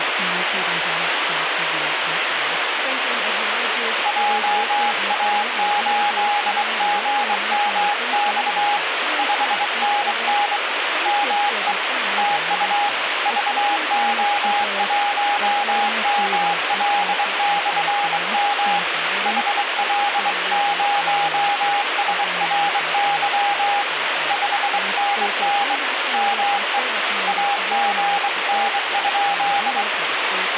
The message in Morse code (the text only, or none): JA8GMX 5NN ME TU VO1ML/M HL0SRY 5NN ME AGN?